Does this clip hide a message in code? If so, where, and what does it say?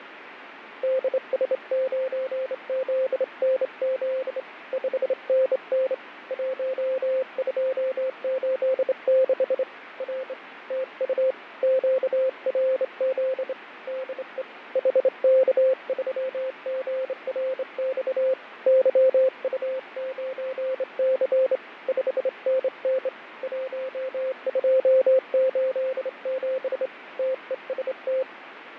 Yes: Morse code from 0.8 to 28.3 s, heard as a keyed tone, hand-sent with a straight key, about 27 wpm, 520 Hz, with radio static and fading. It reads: DS9ZNZ 5NN 1286 R TU QRZ DE HK3GRX YU9C 5NN 1287 TEST